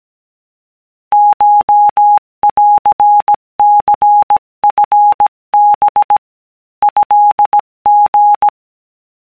Morse code (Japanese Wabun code), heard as a keyed tone, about 17 wpm, 830 Hz. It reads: コンニチハ トリ